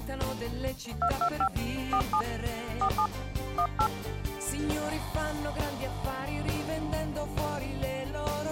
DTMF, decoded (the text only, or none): 225 47 47 18